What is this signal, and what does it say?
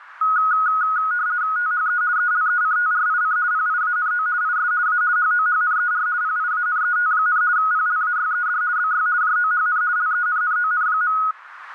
RTTY (50 baud, 170 Hz shift), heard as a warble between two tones, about 1360 Hz centre, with radio static. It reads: THE ELECTRIC PIANO IS A HOHNER PIANET, PLAYED BY JOHN LENNON.